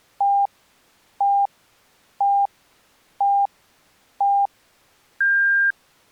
Radio time signal (five pips and a higher one, as on Chinese radio), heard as pips.